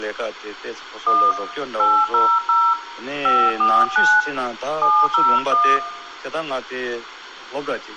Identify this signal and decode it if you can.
DTMF, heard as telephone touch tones, dialled by hand, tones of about 250 ms, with radio hiss and room echo. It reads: 1 800 549 701